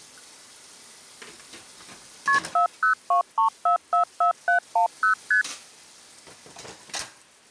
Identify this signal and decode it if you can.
Multi-frequency trunk signalling (R1, as on North American trunks), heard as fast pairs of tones, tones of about 110 ms, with kitchen noise. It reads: KP 4023444710 ST